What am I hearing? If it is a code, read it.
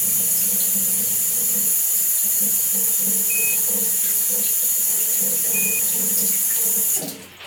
Quindar tones, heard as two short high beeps, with radio hiss, a squelch burst at the end and the noise of a restroom.